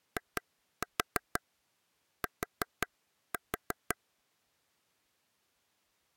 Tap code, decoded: IT

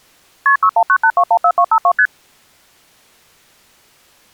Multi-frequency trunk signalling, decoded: KP 6198214252 ST

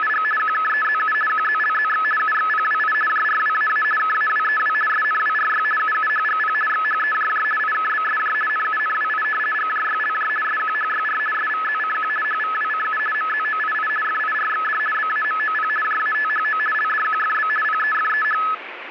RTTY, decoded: … QKEZU QZLZX UXPWI JRWAA KAWEW SNWRY UUHGP XHEJJ IKBSJ NUNWI GJYLJ SQHYR SVZCQ HVWCU MZOII FIRXD BAMOP JATHO LDQFB PEFEH

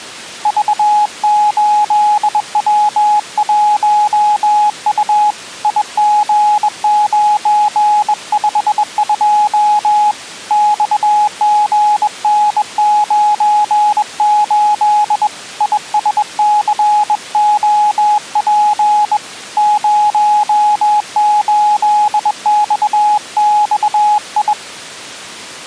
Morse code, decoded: V8W1U IG952 XGN98 ISCOP 08XXI

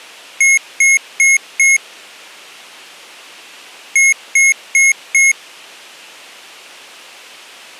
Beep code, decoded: 4 short

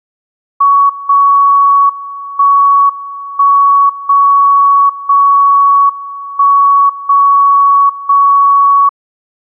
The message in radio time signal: 0 1 1 0 0 1 0 0

